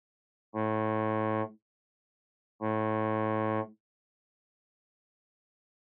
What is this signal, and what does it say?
Ship horn signal, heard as a ship's horn, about 110 Hz. 2 short. At sea: I am altering course to port.